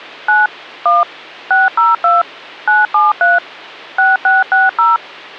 DTMF, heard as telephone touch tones, dialled by machine, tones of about 180 ms, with hum. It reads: 9 1 602 973 6660